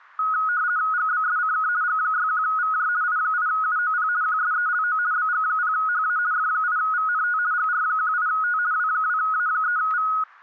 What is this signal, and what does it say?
RTTY (50 baud, 170 Hz shift), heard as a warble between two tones, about 1360 Hz centre, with static crashes. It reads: GBSCK G61VJ I8UOP QSELO BG0HA F8VNT GR18T W2A3V